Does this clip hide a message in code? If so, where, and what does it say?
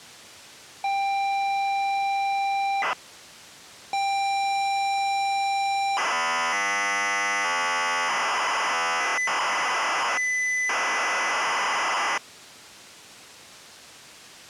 Yes: ZX Spectrum tape loading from 0.8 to 12.2 s, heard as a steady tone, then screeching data.